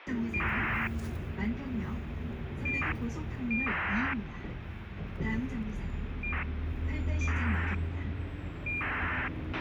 ACARS aircraft data, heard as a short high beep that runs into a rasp, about 2400 baud, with radio hiss, a squelch burst at the end and the noise inside a bus.